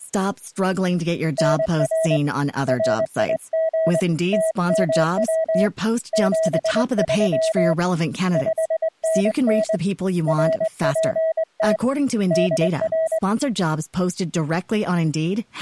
Morse code, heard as a keyed tone, hand-sent with a straight key, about 22 wpm, 650 Hz. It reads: NR RIG TMW 73 5NN RPT DR